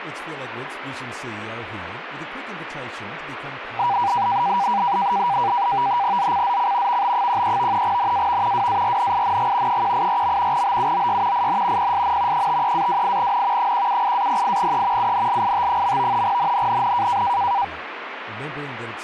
NAVTEX (SITOR-B), 100 baud, 170 Hz shift, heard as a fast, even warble, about 880 Hz centre, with radio static and speech in English. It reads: ZCZC VB13 NAV WARNING 184. BUOY IN PSN 53-28N 178-08E UNLIT. NNNN